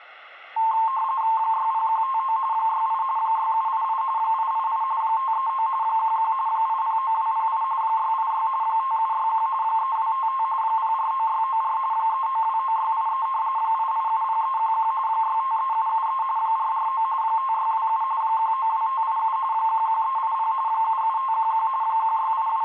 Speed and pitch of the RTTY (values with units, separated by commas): 45.45 baud, 170 Hz shift, 980 Hz centre